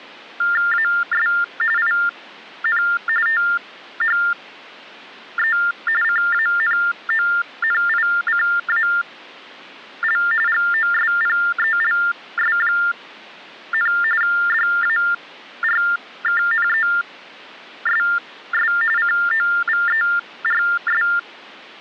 TTY/TDD text telephone tones (45.45 baud Baudot), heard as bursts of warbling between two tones, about 400 Hz shift, 1600 Hz centre. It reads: AS IN THE CANONICAL GOSPELS, DARKNESS COVERS